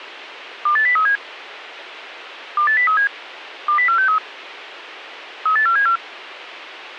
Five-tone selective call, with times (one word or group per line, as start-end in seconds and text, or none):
0.7-1.2 28037
2.6-3.1 28037
3.7-4.2 20463
5.5-6.0 38474